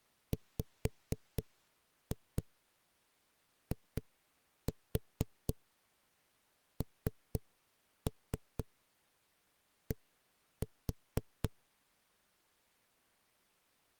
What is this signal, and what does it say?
Tap code, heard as knocks on a wall, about 4 knocks a second. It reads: WIND